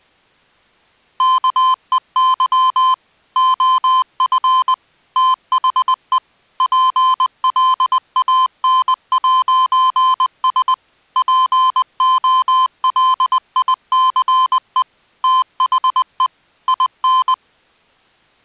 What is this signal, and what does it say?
Morse code, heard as electronic beeps, machine-sent, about 20 wpm, 1030 Hz. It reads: KEY OF THE PLAN'S POLICE THE IN